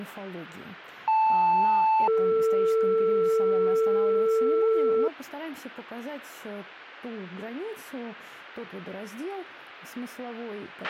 Two-tone page, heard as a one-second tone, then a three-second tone, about 880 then 450 Hz, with a squelch burst at the end.